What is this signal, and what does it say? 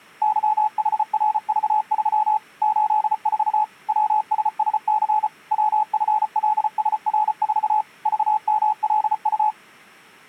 Morse code, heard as a keyed tone, machine-sent, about 34 wpm, 860 Hz. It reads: YHRV3 84 WSSC WFLSR4 VMLU